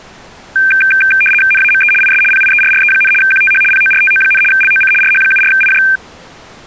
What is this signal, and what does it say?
RTTY (75 baud, 850 Hz shift), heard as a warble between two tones, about 2000 Hz centre. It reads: NAME IS PIERRE, QTH PORTO, LOC RH74IJ